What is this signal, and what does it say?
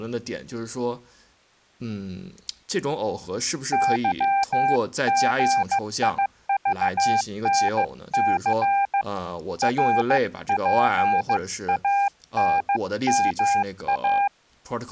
Morse code, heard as a keyed tone, hand-sent with a paddle, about 15 wpm, 800 Hz, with speech in Chinese. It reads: YGIVNC RPANMA